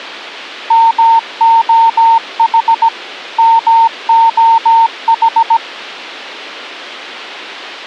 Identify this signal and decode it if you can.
Morse code, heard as a keyed tone, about 17 wpm, 910 Hz. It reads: MOH MOH